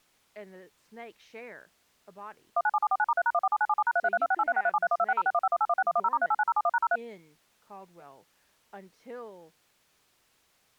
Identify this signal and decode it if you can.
DTMF, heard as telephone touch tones, dialled by machine, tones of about 50 ms, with speech in English. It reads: 197749*3#147977#3332683637312606151816110*389071#03